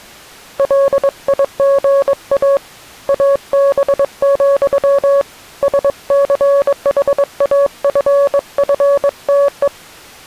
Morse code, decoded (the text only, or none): LIGA AB, SCHAFFTE